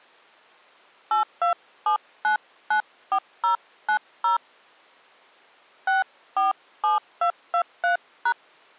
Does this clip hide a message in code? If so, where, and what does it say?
Yes: DTMF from 1.1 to 8.3 s, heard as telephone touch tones, dialled by hand, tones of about 120 ms. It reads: 827994090 647223#